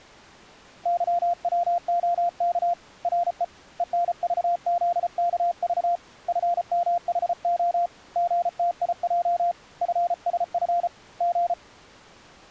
Morse code, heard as a keyed tone, hand-sent with a paddle, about 34 wpm, 700 Hz. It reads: YWOK RE ENVZKV FMHO GTIJ FSF G